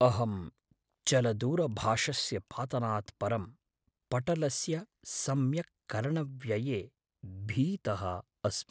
Speech in Sanskrit. There is no code.